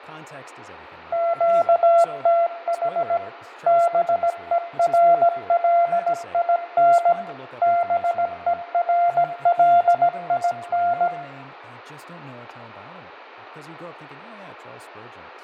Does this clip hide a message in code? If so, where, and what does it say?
Yes: Morse code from 1.1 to 11.1 s, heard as a keyed tone, machine-sent, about 17 wpm, 690 Hz, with fading, room echo and speech in English. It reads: QTH BERLIN BERLIN